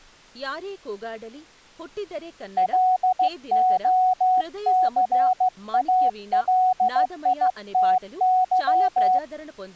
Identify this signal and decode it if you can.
Morse code, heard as a keyed tone, hand-sent with a straight key, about 15 wpm, 740 Hz, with speech in Telugu. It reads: LOCALITY